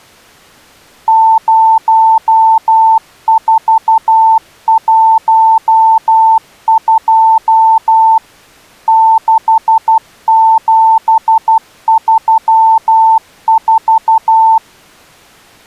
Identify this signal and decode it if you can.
Morse code, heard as a keyed tone, machine-sent, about 12 wpm, 890 Hz. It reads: 0412 6734